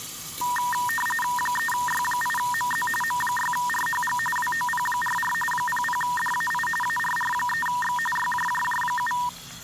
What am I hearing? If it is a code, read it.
RTTY (45.45 baud, 850 Hz shift), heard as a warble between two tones, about 1400 Hz centre, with static crashes and kitchen noise. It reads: 3Y8MZ M6RHG WOP44 00DAI ARR3X YJJJ7